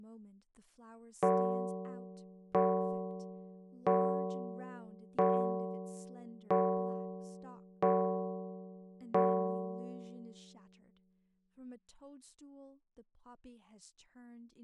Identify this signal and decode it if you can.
Clock strike, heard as a bell, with speech in English. 7. Seven o'clock.